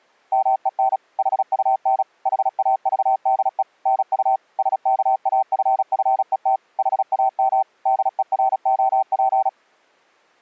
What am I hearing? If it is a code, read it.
Morse code, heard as a keyed tone, machine-sent, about 36 wpm, 770 Hz. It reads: MEN HUN HAVDE NU SKAFFET HAM DEROP